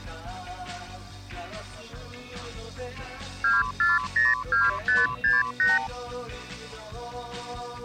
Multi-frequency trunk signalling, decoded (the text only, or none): 2402568